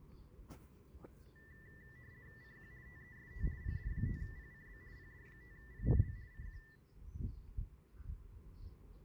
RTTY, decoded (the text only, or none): CQ TEST PD5PCB PD5PCB CQ